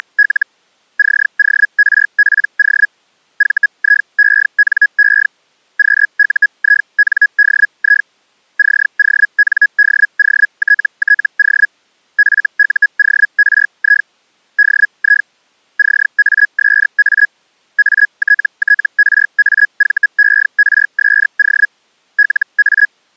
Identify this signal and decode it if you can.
Hellschreiber (Feld-Hell, 122.5 baud), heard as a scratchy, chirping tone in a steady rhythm, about 1650 Hz. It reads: … CORPO VIENE QUINDI CONDOTTO FUORI DI CASA ATTRAVERSO LA